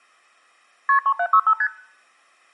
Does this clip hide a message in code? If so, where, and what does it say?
Yes: multi-frequency trunk signalling (R1, as on North American trunks) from 0.9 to 1.7 s, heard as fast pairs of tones, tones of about 70 ms. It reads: KP 3765 ST